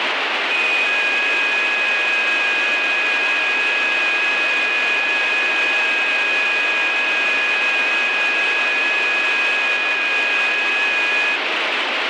FT8 (several signals at once), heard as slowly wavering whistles, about 6.25 baud, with heavy radio static.